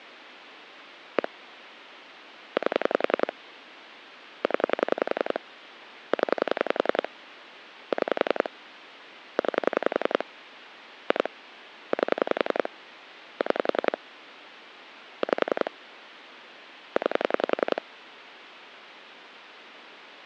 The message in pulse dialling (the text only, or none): 1 8 0 0 6 9 2 8 6 5 9